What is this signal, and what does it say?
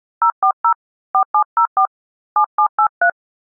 DTMF, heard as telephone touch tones, dialled by hand, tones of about 80 ms. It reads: 040 4704 7783